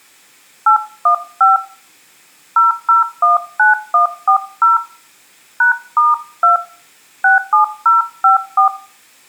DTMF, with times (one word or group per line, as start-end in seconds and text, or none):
0.7-1.6 815
2.6-4.8 0019140
5.6-6.6 #*2
7.2-8.7 67054